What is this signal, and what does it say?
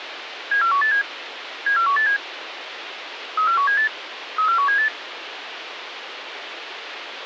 Five-tone selective call (CCIR), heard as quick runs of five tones, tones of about 100 ms, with radio hiss. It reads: 74187 74187 34178 34178